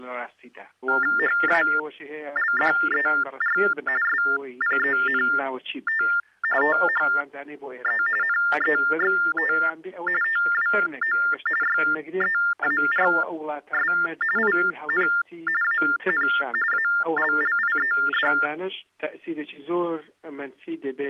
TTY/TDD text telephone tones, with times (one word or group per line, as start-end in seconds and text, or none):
1.2-3.6 HALDER
4.0-6.0 SPENT
6.6-8.0 THE
8.2-9.5 NEXT
10.2-11.2 TWO
11.6-13.9 YEARS
14.4-15.1 IN
15.6-16.3 AN
16.7-18.3 ALLIED